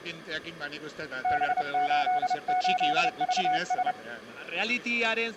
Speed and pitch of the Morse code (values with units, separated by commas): 30 wpm, 740 Hz